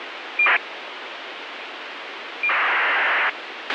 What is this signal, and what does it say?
ACARS aircraft data, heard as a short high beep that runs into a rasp, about 2400 baud, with radio hiss and a squelch burst at the end.